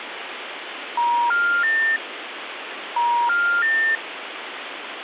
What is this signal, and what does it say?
Telephone call progress tone (ITU plan), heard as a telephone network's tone, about 950, 1400, 1800 Hz, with phone line noise. Special information tone.